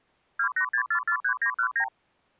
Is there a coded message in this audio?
Yes: multi-frequency trunk signalling (R2, with the far end's replies) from 0.4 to 1.9 s, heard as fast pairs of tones, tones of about 80 ms. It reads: 286443919